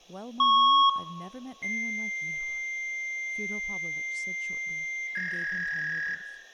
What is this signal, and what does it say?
Fax machine handshake, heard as a beep, a long tone and a warble, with room echo and speech in English.